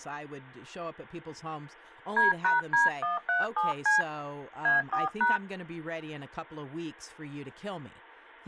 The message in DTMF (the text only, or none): D#D137C A4#